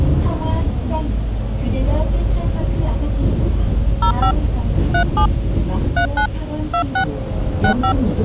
DTMF, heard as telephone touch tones, dialled by hand, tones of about 90 ms, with hum and the noise inside a bus. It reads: 05 37 39 26 65